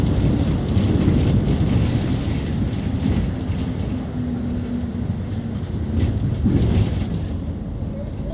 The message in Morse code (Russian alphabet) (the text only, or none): none